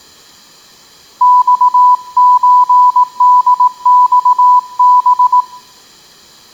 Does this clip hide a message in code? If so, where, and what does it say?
Yes: Morse code (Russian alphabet) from 1.2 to 5.5 s, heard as a keyed tone, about 18 wpm, 990 Hz. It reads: ЬЧДЬБ